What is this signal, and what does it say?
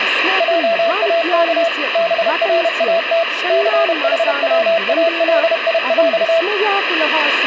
Morse code (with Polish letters), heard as a keyed tone, machine-sent, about 31 wpm, 670 Hz, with radio static and speech in Sanskrit. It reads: JAK BRAT CHWALIŁ